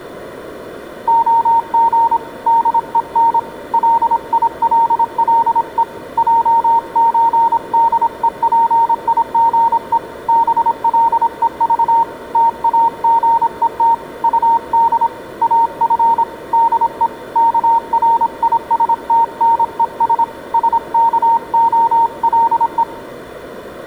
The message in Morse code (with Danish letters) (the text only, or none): OG DEN LILLE JØDEPIGE BLEV TAGET UD AF DE KRISTNES SKOLE